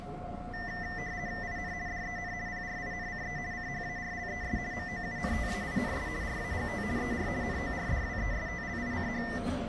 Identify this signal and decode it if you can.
RTTY (50 baud, 170 Hz shift), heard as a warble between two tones, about 1900 Hz centre, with the noise inside a subway train. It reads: IN DEN PRINCE CHARLES MOUNTAINS RAGT ER NORDWESTLICH